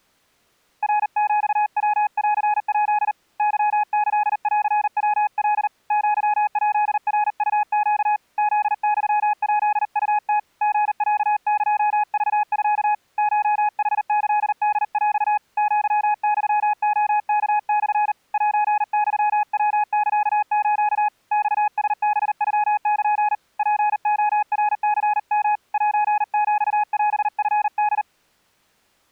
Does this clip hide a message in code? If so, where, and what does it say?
Yes: Morse code (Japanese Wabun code) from 0.8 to 28.1 s, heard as a keyed tone, hand-sent with a paddle, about 39 wpm, 840 Hz. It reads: ナヒヤンヱ ケキンヤカ アヱナウネ フユヱウム リロエクミ コヌキホヰ アユレワモ セユヤサス マラハノル ツレナニヨ セヒオチホ